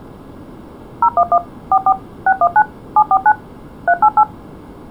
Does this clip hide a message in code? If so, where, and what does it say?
Yes: DTMF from 1.0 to 4.2 s, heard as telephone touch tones, dialled by machine, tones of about 60 ms. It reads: 011 44 619 749 388